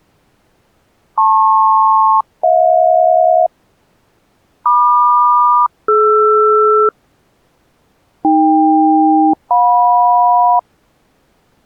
Aircraft SELCAL, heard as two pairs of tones. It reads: LP-HJ MQ-DR AK-JM